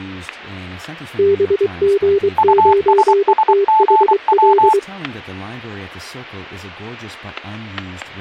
Morse code, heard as two keyed tones, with static crashes and speech in English. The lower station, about 23 wpm, 400 Hz: BG9THL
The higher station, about 24 wpm, 870 Hz: USSGW